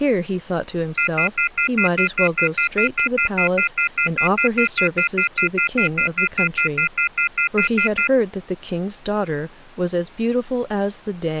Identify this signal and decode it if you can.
Telephone call progress tone (North American plan), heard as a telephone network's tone, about 1400, 2050, 2450, 2600 Hz, 0.1 s on and 0.1 s off, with speech in English. Off-hook warning tone.